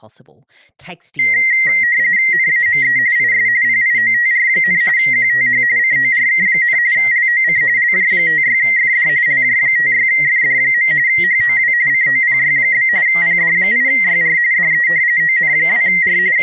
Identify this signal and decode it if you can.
RTTY (45.45 baud, 170 Hz shift), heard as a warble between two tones, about 2000 Hz centre, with speech in English. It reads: NAME IS PIOTR, QTH CORK, LOC LJ56FD LJ56FD. HOW COPY? PD8YR DE ON2R …